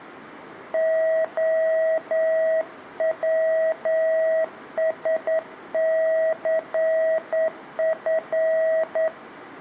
Morse code, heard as a keyed tone, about 9 wpm, 640 Hz, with room echo. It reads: OWSCF